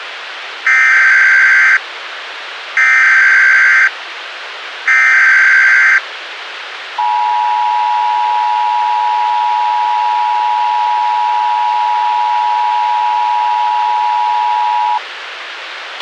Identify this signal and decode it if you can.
Emergency Alert System (SAME) tones (header bursts, then the 853 and 960 Hz attention tone), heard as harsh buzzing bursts, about 520.83 baud, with radio hiss and a squelch burst at the end.